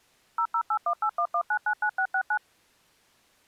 DTMF, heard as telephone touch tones, dialled by machine, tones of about 70 ms. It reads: 0081811999669